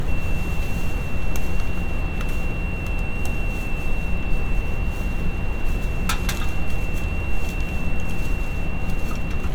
FT8 (one signal), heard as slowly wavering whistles, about 6.25 baud, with radio static, a narrow filter and street noise.